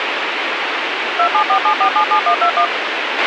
DTMF, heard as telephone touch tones, dialled by machine, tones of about 90 ms, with radio hiss and a squelch burst at the end. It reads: 2747477121